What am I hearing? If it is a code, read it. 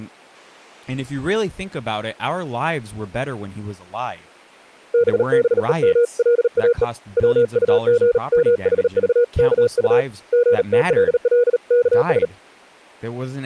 Morse code (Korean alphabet), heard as a keyed tone, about 38 wpm, 480 Hz, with speech in English. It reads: 땀과 빗물이 섞여